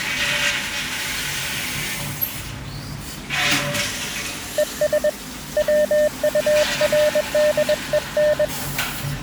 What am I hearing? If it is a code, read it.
Morse code, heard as a keyed tone, hand-sent with a paddle, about 21 wpm, 600 Hz, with the noise of a restroom. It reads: ES WURDEN